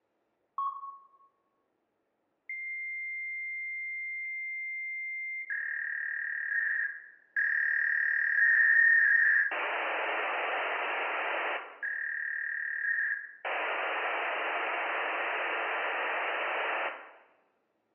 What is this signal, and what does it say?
Fax machine handshake, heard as a long tone, a warble and hiss, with room echo.